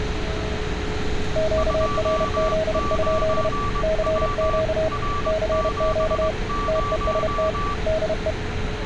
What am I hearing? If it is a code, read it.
Morse code, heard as two keyed tones, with radio static and street noise. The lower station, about 31 wpm, 640 Hz: QRZ? CQ CQ TEST DE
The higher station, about 21 wpm, 1160 Hz: 29W R70